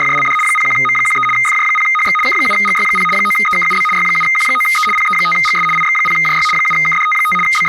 RTTY (75 baud, 850 Hz shift), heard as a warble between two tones, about 1650 Hz centre, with speech in Slovak. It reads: … 01M13 FJ0HX K7GY0 9EKUB Y7Q9E PE5GS IX0JY 7KDT5 …